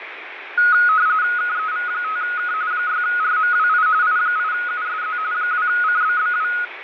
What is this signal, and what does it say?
RTTY (45.45 baud, 170 Hz shift), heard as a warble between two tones, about 1360 Hz centre, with radio static and fading. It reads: KEV5K 6RMWI I8USZ 2CBBW